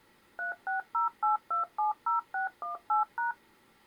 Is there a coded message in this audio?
Yes: DTMF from 0.4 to 3.3 s, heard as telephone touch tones, dialled by machine, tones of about 130 ms. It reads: 3608270618#